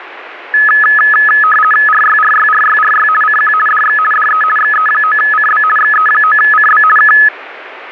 RTTY (50 baud, 450 Hz shift), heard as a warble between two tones, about 1490 Hz centre, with radio static. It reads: RYRYRYRY CQ DX DE XE9CB XE9CB K